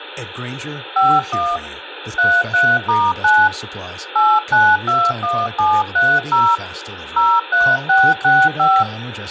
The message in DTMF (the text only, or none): 51 33*9 8921730 03665